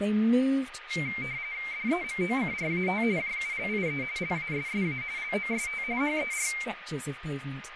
RTTY (45.45 baud, 170 Hz shift), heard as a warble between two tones, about 2200 Hz centre, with radio static, a steady whistle near 1230 Hz and speech in English. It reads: DEMOCRAT JULIE LASSA LOST HER